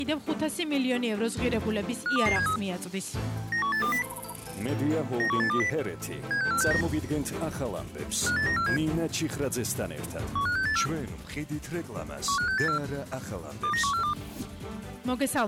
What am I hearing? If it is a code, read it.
Five-tone selective call (CCIR), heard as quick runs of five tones, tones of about 100 ms. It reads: 52273 91820 91820 76469 58947 15684 15684 29142